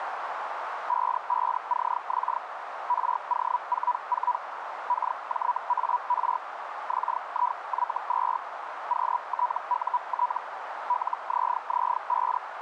Hellschreiber (Feld-Hell, 122.5 baud), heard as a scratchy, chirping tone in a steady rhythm, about 980 Hz, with radio static and a narrow filter. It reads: 55CX RO44 KJAR XIY2 QTUT LZZ5